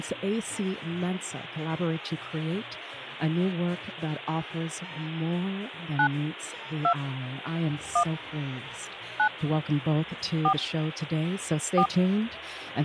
DTMF, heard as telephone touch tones, dialled by hand, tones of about 80 ms. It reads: 9 2 1 9 4 4